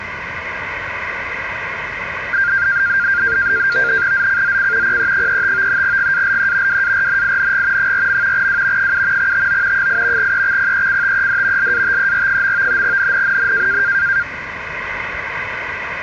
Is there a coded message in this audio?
Yes: NAVTEX (SITOR-B), 100 baud, 170 Hz shift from 2.3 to 14.2 s, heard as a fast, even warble, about 1500 Hz centre, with radio static. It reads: ZCZC PE35 GALE WARNING 4. W 7 TO 8 EXPECTED LATER. NNNN